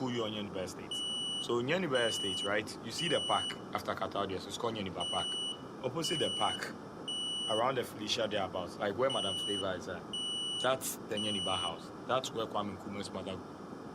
Alarm pattern, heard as an alarm's beeps, played three times, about 2950 Hz, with room echo and speech in English. Temporal three. Smoke or fire, evacuate.